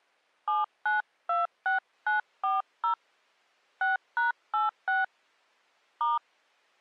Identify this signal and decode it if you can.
DTMF, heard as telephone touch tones, dialled by hand, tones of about 140 ms. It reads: 7926940 6#86 *